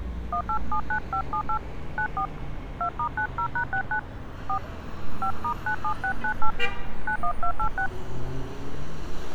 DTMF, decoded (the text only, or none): 1879578 94 2*90#69 4 5*97698 91286